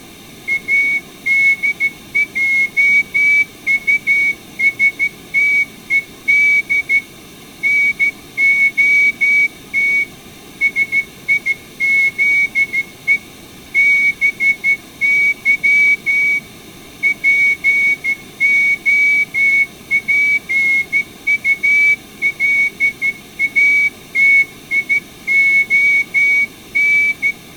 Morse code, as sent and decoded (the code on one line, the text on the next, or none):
.- -.. .--- ..- ... - . -.. / -. --- - / ... .. --.. . / -... -.-- / .--. --- .--. ..- .-.. .- - .. --- -.
ADJUSTED NOT SIZE BY POPULATION